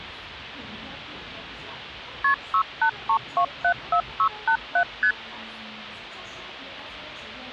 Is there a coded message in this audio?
Yes: multi-frequency trunk signalling (R1, as on North American trunks) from 2.2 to 5.1 s, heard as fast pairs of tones, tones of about 80 ms, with the noise of a subway station. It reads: KP 683274687 ST